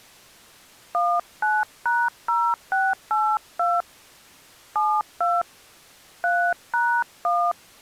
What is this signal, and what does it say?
DTMF, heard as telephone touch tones, dialled by hand, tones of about 230 ms. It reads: 19#0682 72 3#1